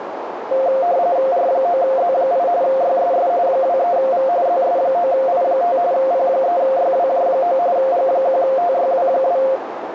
RTTY (45.45 baud, 170 Hz shift), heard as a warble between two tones, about 620 Hz centre, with radio static and a narrow filter. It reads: R9Z8 YSS 23V ZS9I5 P3YWJ9 G1TYW2